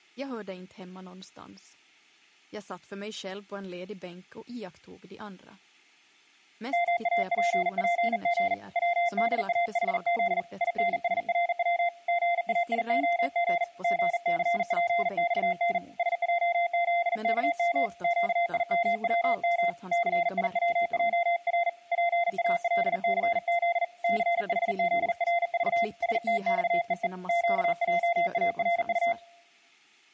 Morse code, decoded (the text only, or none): MAPPG WDAHZ INSRW GAIOG GCPXN SJZKM QIMWM CIWJR PALCZ CHZRV STXEE QJARU